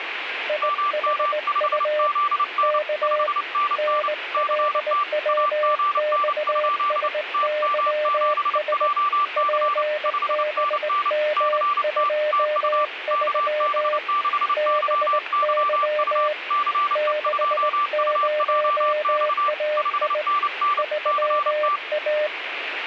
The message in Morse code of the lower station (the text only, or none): IHU K NLWXSYS PBM23 BY 60AI 3A